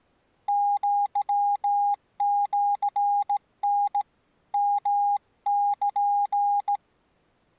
Morse code (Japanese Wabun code), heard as a keyed tone, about 16 wpm, 810 Hz. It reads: アシタ ヨル